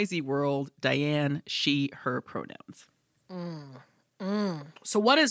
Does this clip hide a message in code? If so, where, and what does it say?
No, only speech in English.